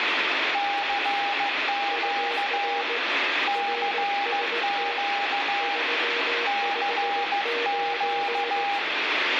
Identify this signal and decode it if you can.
Morse code, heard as two keyed tones, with radio static and speech in English. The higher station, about 15 wpm, 810 Hz: CQ CQ CQ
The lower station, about 18 wpm, 470 Hz: UR RST 359